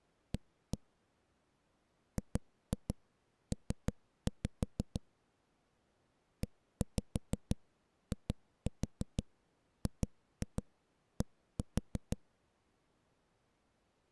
Tap code, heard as knocks on a wall, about 6 knocks a second. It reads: A GP EIGD